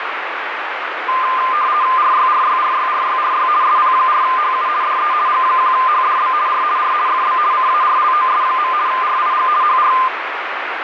RTTY (50 baud, 170 Hz shift), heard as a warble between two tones, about 1120 Hz centre, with radio static. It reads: RYRYRYRYRY SP4HU DE G1HDB R R FB CARLOS. RIG HR